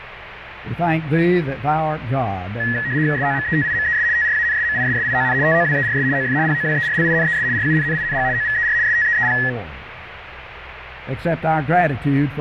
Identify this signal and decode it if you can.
RTTY (75 baud, 170 Hz shift), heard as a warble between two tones, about 1800 Hz centre, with radio static. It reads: SOMETIMES TRANSMISSION TOWERS OF POWERLINES RUNNING OVER STEEP